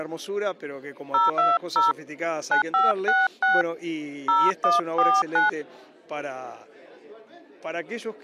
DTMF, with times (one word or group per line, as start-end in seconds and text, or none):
1.1-1.9 020
2.5-3.6 9566
4.3-5.5 0149